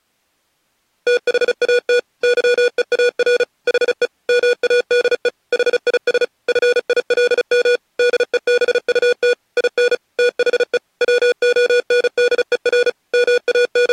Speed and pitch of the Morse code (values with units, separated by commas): 35 wpm, 490 Hz